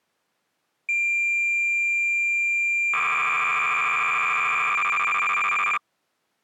Cassette data (Kansas City type), 300 baud, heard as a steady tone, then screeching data.